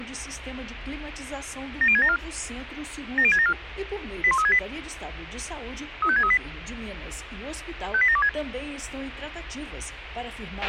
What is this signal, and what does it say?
Five-tone selective call (ZVEI), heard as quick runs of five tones, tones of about 70 ms, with radio hiss and a squelch burst at the end. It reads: 70674 70674 81368 35638 58726